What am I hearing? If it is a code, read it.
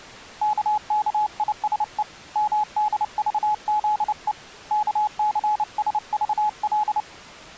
Morse code, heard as a keyed tone, hand-sent with a paddle, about 29 wpm, 850 Hz. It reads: KKISE MDVZE KCSVL